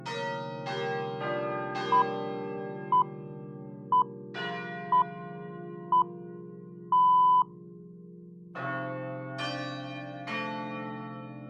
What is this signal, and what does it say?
Radio time signal (six pips, as the Greenwich Time Signal), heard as pips.